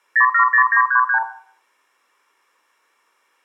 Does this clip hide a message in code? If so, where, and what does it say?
Yes: multi-frequency trunk signalling (R2, with the far end's replies) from 0.2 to 1.2 s, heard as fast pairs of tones, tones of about 90 ms, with room echo. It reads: 070933